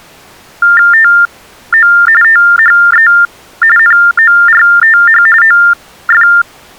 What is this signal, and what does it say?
TTY/TDD text telephone tones (45.45 baud Baudot), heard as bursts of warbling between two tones, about 400 Hz shift, 1600 Hz centre. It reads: TO THE NORTH OF